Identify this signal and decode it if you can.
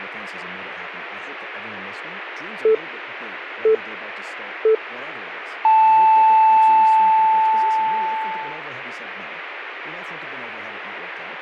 Radio time signal (three low pips and a long one an octave up, as on NHK), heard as pips, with speech in English.